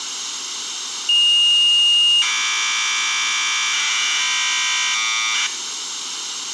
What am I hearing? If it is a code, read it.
Commodore tape loading (standard loader), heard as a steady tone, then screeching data, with tape hiss.